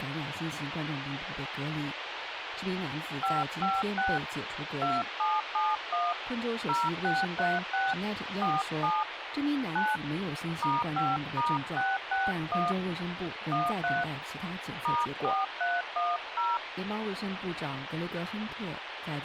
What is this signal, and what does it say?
DTMF, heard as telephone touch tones, dialled by hand, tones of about 200 ms, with radio hiss. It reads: 556 2771 0636 47 9 *5*661 13 *4310